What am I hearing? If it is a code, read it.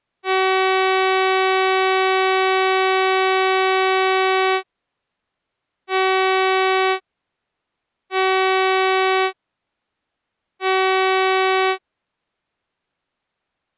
Ship horn signal, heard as a ship's horn, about 380 Hz. 1 long, 3 short. At sea: a vessel under tow in fog.